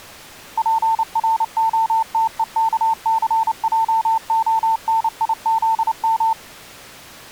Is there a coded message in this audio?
Yes: Morse code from 0.5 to 6.4 s, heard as a keyed tone, machine-sent, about 29 wpm, 900 Hz. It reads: PROTEKCJONIZM